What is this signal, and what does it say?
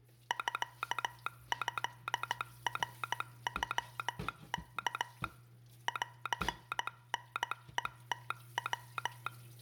Morse code (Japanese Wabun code), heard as a telegraph sounder, hand-sent with a straight key, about 15 wpm, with kitchen noise. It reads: ミトナノワ ンタヘムヤ